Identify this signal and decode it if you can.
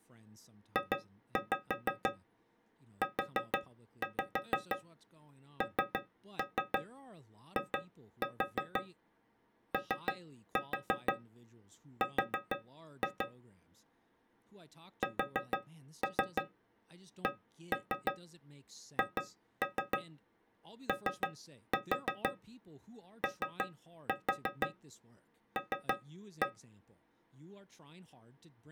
Tap code, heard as taps on a metal pipe, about 6 knocks a second, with speech in English. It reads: JUNIOR SCHOOL